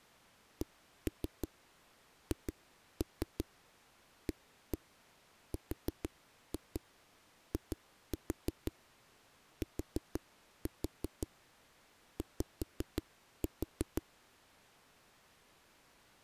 Tap code, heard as knocks on a wall, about 5 knocks a second. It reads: CHARITY